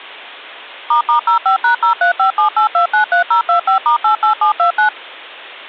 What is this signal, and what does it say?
DTMF, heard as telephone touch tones, dialled by machine, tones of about 110 ms. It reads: **05#03578293025*88729